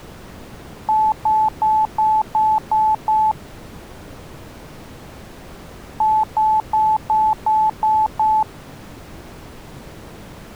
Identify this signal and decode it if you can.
Beep code, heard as beeps, played twice, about 870 Hz. 7 short. In AMI BIOS tables: virtual mode exception error; in Dell tables: processor failure.